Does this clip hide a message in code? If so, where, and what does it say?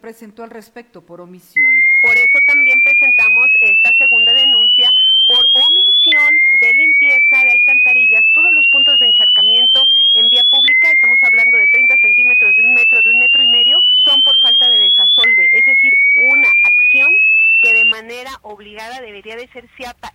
No, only a tone that sweeps in pitch again and again.